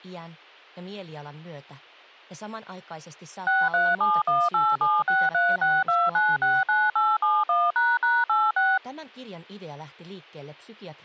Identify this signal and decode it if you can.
DTMF, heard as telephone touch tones, dialled by machine, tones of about 210 ms. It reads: 6371876362969871##86